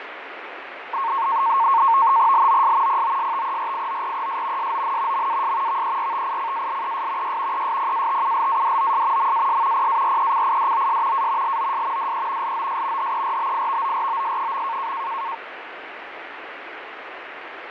NAVTEX (SITOR-B), 100 baud, 170 Hz shift, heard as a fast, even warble, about 1000 Hz centre, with radio static and fading. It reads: LOS POSTERIORES SON MAS VERTICALES Y ESPATULADOS MAS PARECIDOS A LOS DE LOS HERBIVOROS.